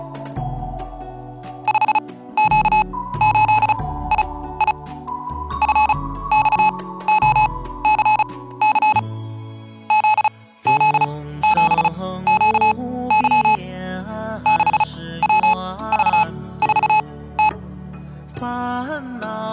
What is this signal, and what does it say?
Morse code, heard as electronic beeps, machine-sent, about 35 wpm, spaced as for 17 wpm, 860 Hz. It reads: 5Q8II FXOCC ZZ7QY 6WV4T